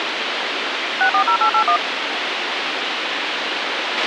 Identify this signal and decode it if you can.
DTMF, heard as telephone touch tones, dialled by machine, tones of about 90 ms, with radio hiss and a squelch burst at the end. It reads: 640881